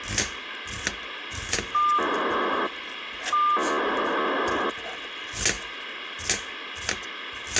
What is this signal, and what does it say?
POCSAG pager data (2400 baud), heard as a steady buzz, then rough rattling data, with radio hiss, a squelch burst at the end and kitchen noise.